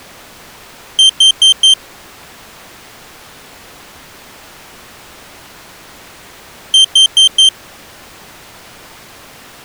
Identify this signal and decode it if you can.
Alarm pattern, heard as an alarm's beeps, played twice, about 3150 Hz. Temporal four. Carbon monoxide.